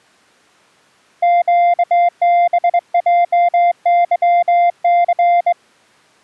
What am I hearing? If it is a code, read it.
Morse code, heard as a keyed tone, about 22 wpm, 700 Hz. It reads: QBJYC